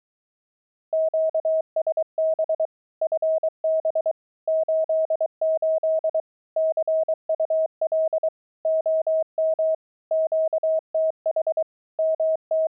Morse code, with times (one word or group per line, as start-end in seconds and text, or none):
0.9-2.7 QSB
3.0-4.1 FB
4.5-6.2 88
6.6-8.3 CUL
8.7-9.7 OM
10.1-11.6 QTH
12.0-12.7 …